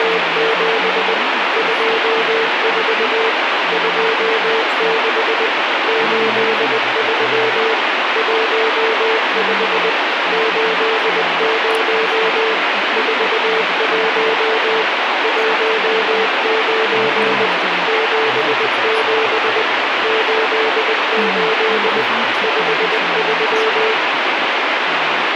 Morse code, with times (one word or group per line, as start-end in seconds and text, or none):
0.0-1.1 …
1.6-3.3 24
3.7-5.5 26
5.9-7.7 83
8.2-9.9 15
10.3-12.5 80
13.0-14.8 41
15.2-17.5 19
17.9-19.6 77
20.0-22.0 88
22.4-23.9 53